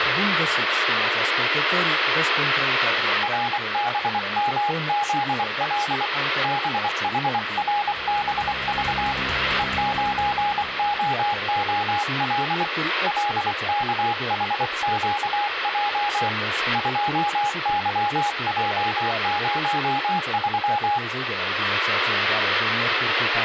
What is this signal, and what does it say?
Morse code, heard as a keyed tone, hand-sent with a paddle, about 24 wpm, 830 Hz, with radio static. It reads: RBMZL BHRBV E9OOL LKHQJ 2YJ03